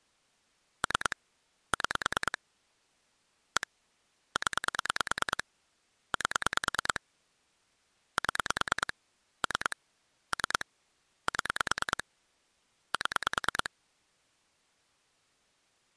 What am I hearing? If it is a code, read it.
Pulse dialling, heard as clicks on a phone line, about 9 pulses a second. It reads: 3 6 1 0 8 7 3 3 7 7